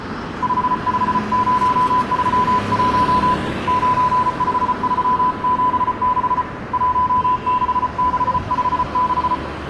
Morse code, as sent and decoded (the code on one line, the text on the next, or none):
..... ..... ----- ...-- .---- / ----. ..... ...-- --... -.... / .---- -.... -.... ..... -....
55031 95376 16656